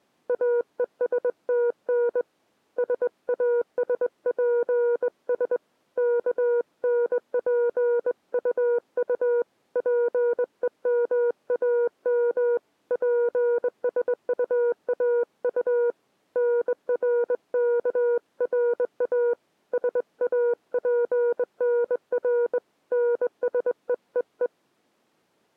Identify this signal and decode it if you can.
Morse code, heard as a keyed tone, hand-sent with a straight key, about 21 wpm, 480 Hz. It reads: AESTN SASPS KNPUU PEMAM PSUAU NRKRA SAPNR NSEEE